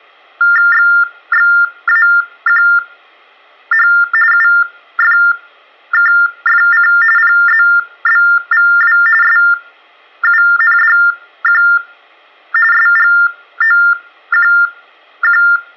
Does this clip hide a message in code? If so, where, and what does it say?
Yes: TTY/TDD text telephone tones (45.45 baud Baudot) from 0.4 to 15.6 s, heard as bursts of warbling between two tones, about 400 Hz shift, 1600 Hz centre, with room echo. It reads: XXAQH UFKFC PZBVW SUNDQ SGOQQ